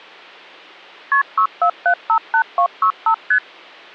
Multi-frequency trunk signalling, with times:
1.1-1.2 KP
1.4-3.1 64758265
3.3-3.4 ST

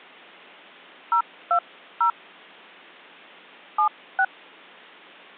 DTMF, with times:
1.1-2.1 020
3.8-4.2 76

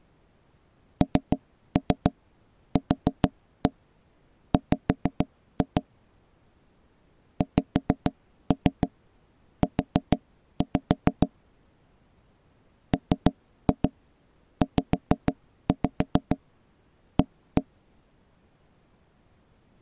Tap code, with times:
1.0-5.8 NQW
7.4-11.3 XU
12.9-17.6 MZA

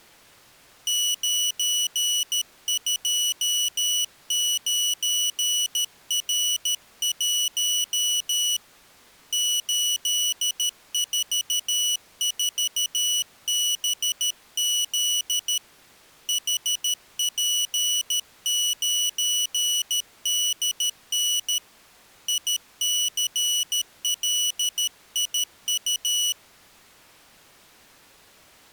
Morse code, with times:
0.9-8.6 929R1
9.3-15.6 844BZ
16.3-21.6 HP9DN
22.3-26.3 ICLIU

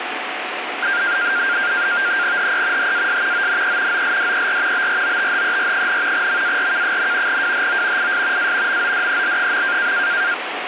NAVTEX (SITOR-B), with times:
2.4-2.9 HE
2.8-3.5 HAS
3.3-4.0 ONE
3.9-4.9 OLDER
4.7-6.3 BROTHER,
6.1-7.4 MARK,
7.3-8.1 WHO
8.0-8.5 IS
8.4-8.8 A
8.7-9.9 MODEL.

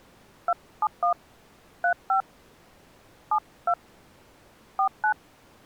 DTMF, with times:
0.5-1.1 271
1.8-2.2 35
3.3-3.7 72
4.8-5.1 49

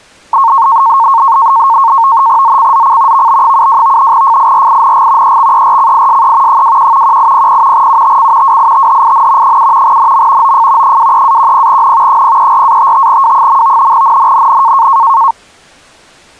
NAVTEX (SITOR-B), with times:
2.4-3.3 ZCZC
3.1-4.1 VB72
4.1-5.4 FIRING
5.2-6.6 EXERCISE
6.5-7.2 21
7.0-7.9 1800
7.7-8.6 UTC
8.4-9.6 WITHIN
9.4-10.0 7
9.8-10.5 NM
10.4-11.0 OF
10.8-12.2 23-10N
12.1-13.9 034-55W.
13.9-14.9 NNNN

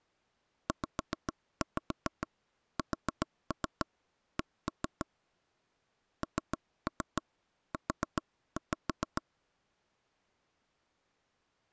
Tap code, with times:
0.7-5.1 ZSC
6.2-9.2 NU

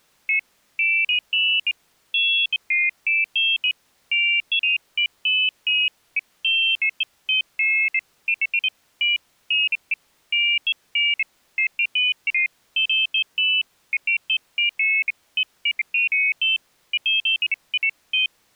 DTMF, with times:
none

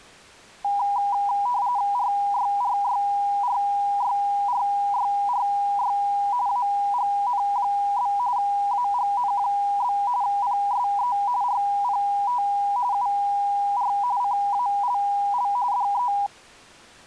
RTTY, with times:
1.9-6.0 RYRYRYRYRY
6.5-8.1 AGN?
8.4-10.0 AGN?
10.2-11.2 PSE
11.4-12.4 RPT
12.9-13.9 UR
14.2-15.5 CALL
15.7-16.1 DE

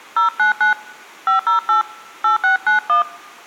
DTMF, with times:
0.2-0.7 099
1.3-1.8 508
2.2-3.0 8691

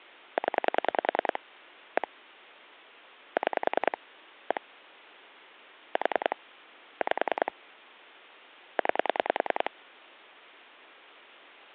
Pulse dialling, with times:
0.4-1.4 0
2.0-2.1 1
3.4-4.0 6
4.5-4.6 1
6.0-6.4 4
7.0-7.5 5
8.8-9.7 9

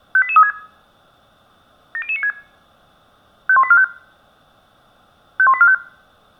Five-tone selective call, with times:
0.2-0.5 58836
1.9-2.3 70096
3.5-3.8 51845
5.4-5.7 51845

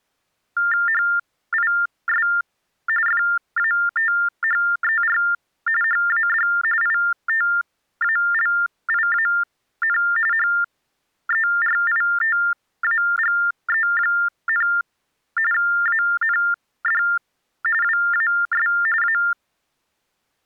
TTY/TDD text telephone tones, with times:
0.9-2.3 HIS
3.1-5.2 FATHER
5.8-6.5 HAD
6.8-10.0 ITALIAN
10.3-14.7 HERITAGE,
15.5-17.0 AND
17.8-18.7 WAS
19.0-19.2 A

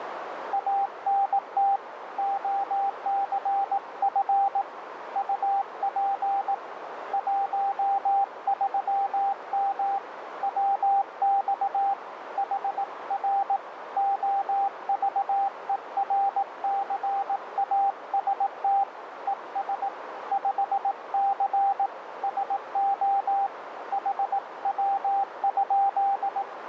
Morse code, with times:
0.5-1.8 ANT
2.2-4.6 OCF
5.2-6.5 UP
7.1-10.0 13M
10.4-11.9 WX
12.4-13.6 HR
14.0-18.8 OVERCAST
19.3-19.9 ES
20.3-21.9 5C
22.2-23.5 SO
23.9-26.4 HW?

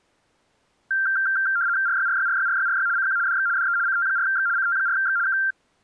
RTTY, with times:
1.9-2.9 RYRYRYRYRY
3.0-3.2 CQ
3.3-3.5 DX
3.6-3.8 DE
3.9-4.5 CT4X
4.6-5.2 CT4X
5.3-5.4 K

